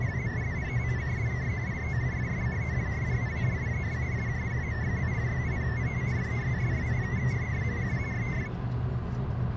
Multi-tone FSK (Olivia or MFSK type), about 500 Hz wide, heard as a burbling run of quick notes, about 62.5 baud, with the noise inside a car.